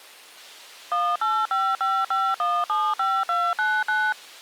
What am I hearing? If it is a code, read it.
DTMF, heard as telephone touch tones, dialled by machine, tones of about 240 ms. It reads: 18555175299